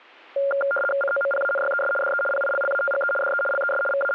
RTTY (75 baud, 850 Hz shift), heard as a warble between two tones, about 980 Hz centre. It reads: COMPANYES DE PILLATGE DE LES …